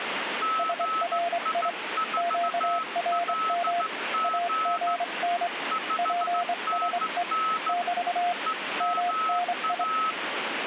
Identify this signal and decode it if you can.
Morse code, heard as two keyed tones, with radio static. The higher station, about 15 wpm, 1300 Hz: GI4LG 5NN EMA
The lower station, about 25 wpm, 700 Hz: SRI QRM AGN PSE <BT> MNI